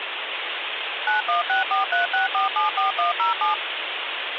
DTMF, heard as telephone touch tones, dialled by machine, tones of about 130 ms, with phone line noise. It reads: 916436474107